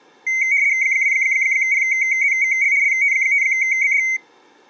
RTTY (75 baud, 170 Hz shift), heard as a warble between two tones, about 2150 Hz centre. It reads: 2PZVL LT5BD